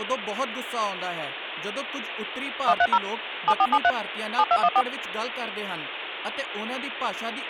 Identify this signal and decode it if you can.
DTMF, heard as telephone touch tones, dialled by machine, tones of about 60 ms, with phone line noise and speech in Punjabi. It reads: 130 7473 7214